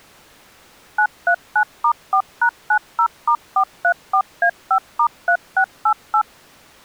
DTMF, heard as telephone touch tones, dialled by machine, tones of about 80 ms. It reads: 939*4#90*434A5*3688